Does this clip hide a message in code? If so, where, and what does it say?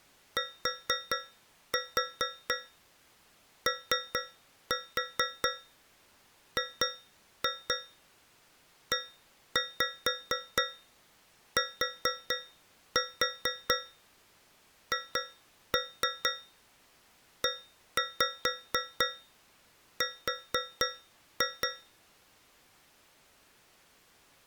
Yes: tap code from 0.4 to 22.0 s, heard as taps on a metal pipe, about 4 knocks a second. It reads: TOGETHER